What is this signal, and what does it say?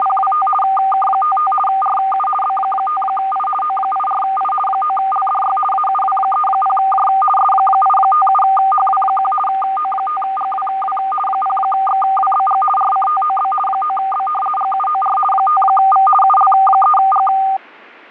RTTY (50 baud, 450 Hz shift), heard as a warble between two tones, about 1000 Hz centre, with fading. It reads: … K55 RU B5I O84I 9LDY AUW30J S857HW1 O5GWW 0XWBG RCTOB 9B GUOR 5V UL3G